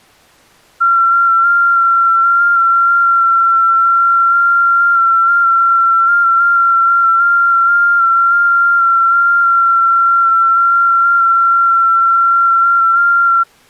FT8 (one signal), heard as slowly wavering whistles, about 6.25 baud.